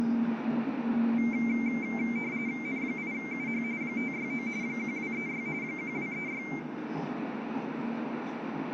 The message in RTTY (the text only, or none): N8UH 569 1236 1236